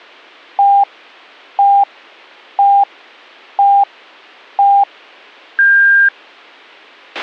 Radio time signal (five pips and a higher one, as on Chinese radio), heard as pips, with a squelch burst at the end.